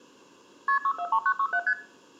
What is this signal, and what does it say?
Multi-frequency trunk signalling (R1, as on North American trunks), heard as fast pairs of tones, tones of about 70 ms, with room echo. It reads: KP 643967 ST